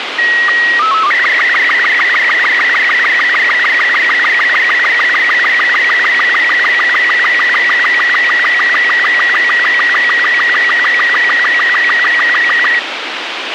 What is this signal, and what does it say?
SSTV (slow-scan television), Robot 36, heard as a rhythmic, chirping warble, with radio hiss and a squelch burst at the end.